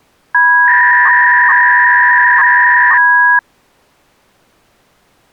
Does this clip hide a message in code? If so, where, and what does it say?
Yes: 300-baud modem data (V.21 tones) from 0.3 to 3.4 s, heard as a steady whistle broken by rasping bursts, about 300 baud, 200 Hz shift.